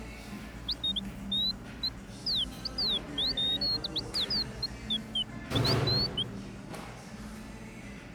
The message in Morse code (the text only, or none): none